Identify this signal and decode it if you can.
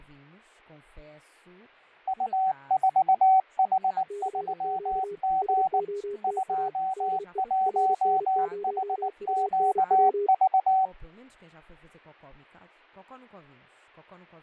Morse code, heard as two keyed tones, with fading and speech in Portuguese. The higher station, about 19 wpm, 760 Hz: U4H3G 21HQV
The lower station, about 31 wpm, 410 Hz: CQ SOTA DE RN0UNW